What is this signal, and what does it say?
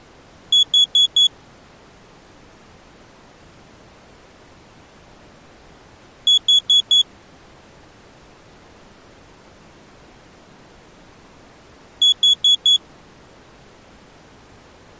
Alarm pattern, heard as an alarm's beeps, played three times, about 3400 Hz. Temporal four. Carbon monoxide.